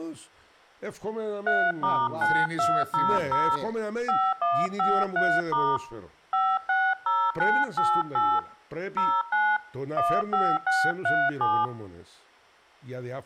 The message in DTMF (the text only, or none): 3*9200 5153* 560988 09 15637